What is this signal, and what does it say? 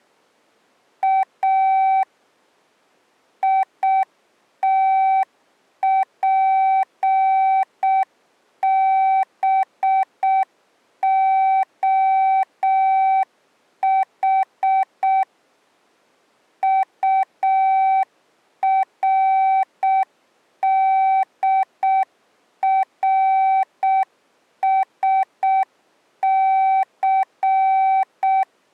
Morse code (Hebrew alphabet), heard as a keyed tone, machine-sent, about 6 wpm, 770 Hz. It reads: א יתפבהח טרדרשס